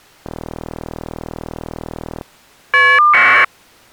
Caller ID data burst, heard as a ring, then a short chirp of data, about 1200 baud.